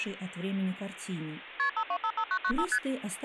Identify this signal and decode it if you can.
Multi-frequency trunk signalling (R1, as on North American trunks), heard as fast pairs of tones, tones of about 70 ms. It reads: KP 5255995 ST